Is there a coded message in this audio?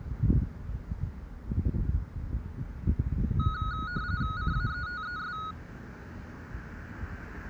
Yes: RTTY (45.45 baud, 170 Hz shift) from 3.4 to 5.5 s, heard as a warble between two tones, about 1360 Hz centre, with street noise. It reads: CAETES